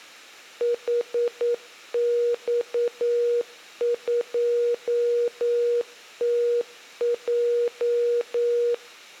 Morse code, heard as a keyed tone, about 9 wpm, 480 Hz. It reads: HX2TJ